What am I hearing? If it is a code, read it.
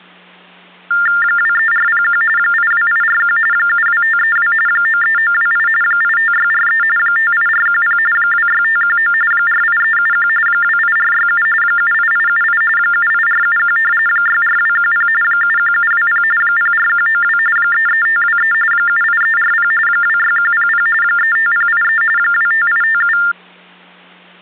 TTY/TDD text telephone tones (45.45 baud Baudot), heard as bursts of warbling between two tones, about 400 Hz shift, 1600 Hz centre, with hum. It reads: 23401 82841 72532 93928 85643 58410 26519 48371 28467 78878 78471 64210 71720 04192 33523 78340 26100 35083 25857